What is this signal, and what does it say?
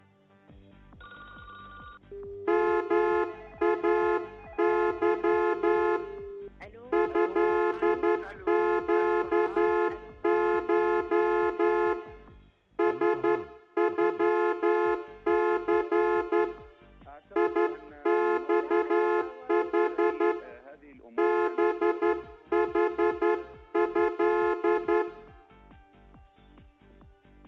Morse code (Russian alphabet), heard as a horn, hand-sent with a straight key, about 11 wpm, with room echo. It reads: МАЫ ЭЩШ СЮЦ ИЬХ БХЭ